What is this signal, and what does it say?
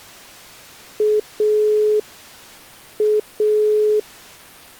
Telephone call progress tone (pulsed, as in Italy), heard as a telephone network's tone, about 420 Hz. Dial tone.